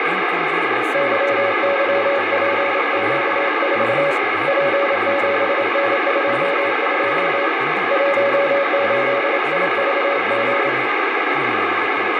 Morse code, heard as a keyed tone, hand-sent with a paddle, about 27 wpm, 560 Hz, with heavy radio static and speech in Manipuri. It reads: YYPQ4 P7N22 18IVG